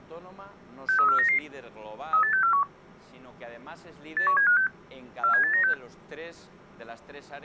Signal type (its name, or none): five-tone selective call